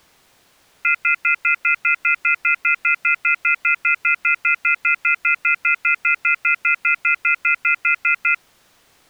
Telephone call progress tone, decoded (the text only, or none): off-hook warning tone